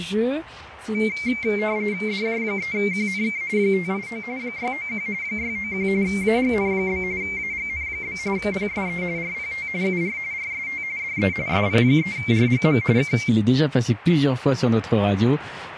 RTTY (45.45 baud, 170 Hz shift), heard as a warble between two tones, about 2200 Hz centre, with radio static. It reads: DJ3QNK 589 691 691 AGN? AGN? PSE RPT UR RST DE SP3RGM K